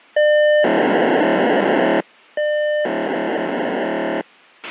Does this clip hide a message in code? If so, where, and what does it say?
Yes: POCSAG pager data (1200 baud) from 0.2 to 4.2 s, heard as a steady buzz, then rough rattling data, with a squelch burst at the end.